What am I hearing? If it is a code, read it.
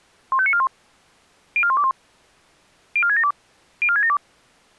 Five-tone selective call (ZVEI), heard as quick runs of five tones, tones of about 70 ms. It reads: 15941 04121 04672 04672